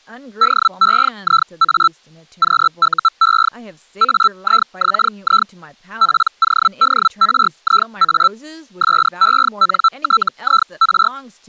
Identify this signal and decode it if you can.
Hellschreiber (Feld-Hell, 122.5 baud), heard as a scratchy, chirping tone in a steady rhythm, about 1330 Hz, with speech in English. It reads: DEIA QUE AIXI PODRIA SENTIR